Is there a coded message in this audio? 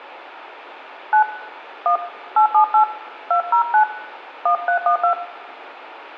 Yes: DTMF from 1.1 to 5.1 s, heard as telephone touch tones, dialled by hand, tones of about 100 ms, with room echo. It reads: 9 1 878 209 1312